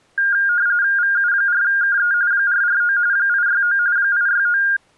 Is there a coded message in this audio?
Yes: RTTY (45.45 baud, 170 Hz shift) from 0.2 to 4.8 s, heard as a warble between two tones, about 1500 Hz centre. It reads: VU4KE 449 869 869